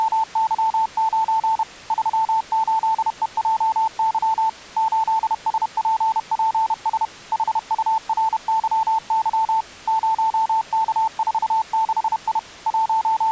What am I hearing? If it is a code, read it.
Morse code, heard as a keyed tone, machine-sent, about 31 wpm, 890 Hz. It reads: … 38EJY 8SPPS HURYY 0K46I …